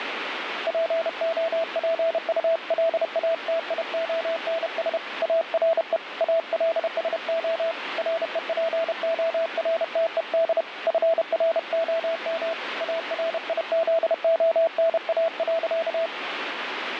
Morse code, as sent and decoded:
.--. --- .--. ..- .-.. .- - .. --- -. ... / .- .-. . / .- .-.. ... --- / .-. . .--. --- .-. - . -.. / ..-. .-. --- -- / .- .-. .. --.. --- -. .- .-.-.-
POPULATIONS ARE ALSO REPORTED FROM ARIZONA.

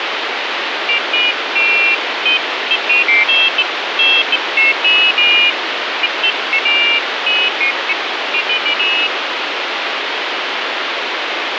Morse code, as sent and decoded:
none

